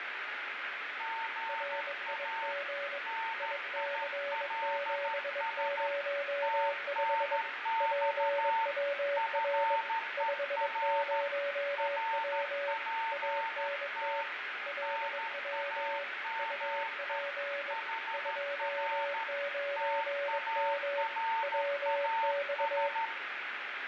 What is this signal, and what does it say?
Morse code, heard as two keyed tones, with radio static, fading and room echo. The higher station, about 13 wpm, 900 Hz: GA NILS TNX FER RPT NAME HR TARAS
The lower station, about 22 wpm, 570 Hz: RIG IC705 PWR 50W ANT LW UP 29M WX